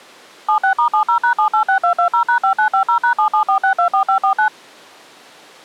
DTMF, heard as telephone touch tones, dialled by machine, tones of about 100 ms. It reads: 76*70#786220#5950#774624549